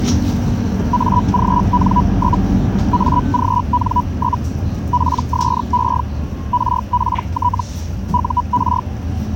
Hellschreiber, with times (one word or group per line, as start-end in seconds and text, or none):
0.9-2.4 AGN?
2.9-4.4 AGN?
4.9-6.0 PSE
6.5-7.6 RPT
8.1-8.8 UR